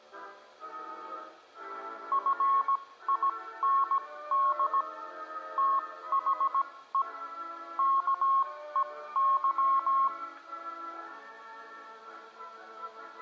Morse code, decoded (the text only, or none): FIND THE KEY